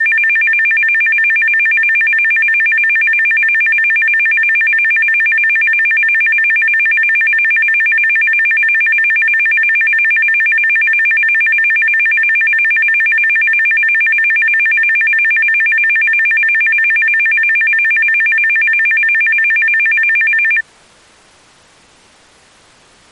A tone that alternates evenly between two pitches. There is no code.